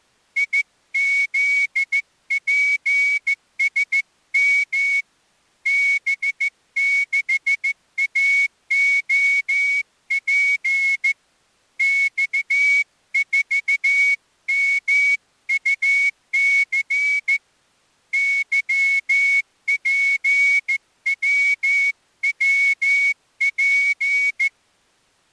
Morse code, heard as a whistle, hand-sent with a straight key, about 14 wpm. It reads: IZPSM B6AOP X4MUC YPWWP